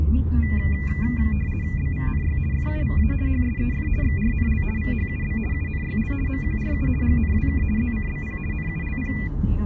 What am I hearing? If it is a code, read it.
RTTY (50 baud, 450 Hz shift), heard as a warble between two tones, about 2200 Hz centre, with room echo and the noise inside a car. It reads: BVNY FUVA HSEF XRNL VHUB UNYL MQRU GNWK ZCBP NULP